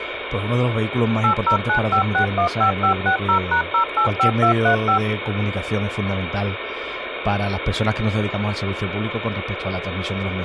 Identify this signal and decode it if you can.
DTMF, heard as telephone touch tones, dialled by machine, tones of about 100 ms, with phone line noise. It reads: 8095615560#085235